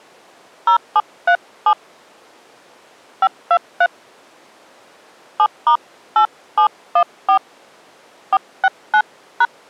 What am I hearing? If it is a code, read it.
DTMF, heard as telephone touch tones, dialled by hand, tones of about 70 ms. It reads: 0737 523 7*8714 469#